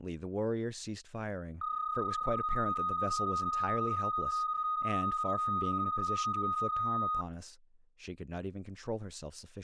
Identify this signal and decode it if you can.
PSK31 (31.25 baud), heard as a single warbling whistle, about 1240 Hz, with speech in English.